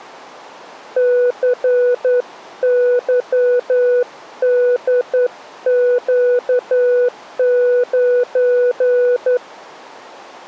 Morse code, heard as a keyed tone, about 10 wpm, 490 Hz. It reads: CYDQ9